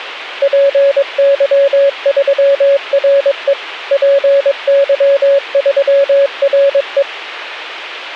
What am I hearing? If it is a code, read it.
Morse code, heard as a keyed tone, machine-sent, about 22 wpm, 560 Hz, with a squelch burst at the end. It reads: PY3RE PY3RE